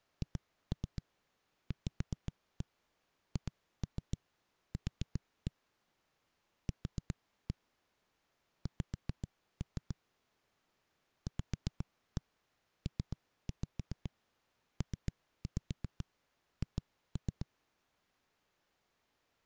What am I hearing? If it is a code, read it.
Tap code, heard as knocks on a wall, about 7 knocks a second. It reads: HVHQ Q X VPPH